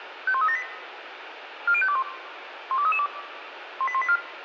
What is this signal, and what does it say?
Five-tone selective call (ZVEI), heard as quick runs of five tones, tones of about 70 ms, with radio hiss. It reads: 51378 40521 12332 18184